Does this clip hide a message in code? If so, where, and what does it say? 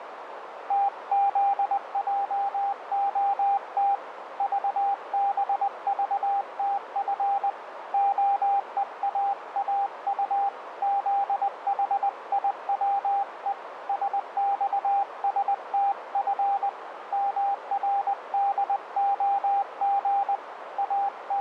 Yes: Morse code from 0.6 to 21.4 s, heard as a keyed tone, hand-sent with a paddle, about 20 wpm, 800 Hz, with radio static and a narrow filter. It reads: TZJOT VBVTF OEAAU ZHIWE SXSTF MRDOG …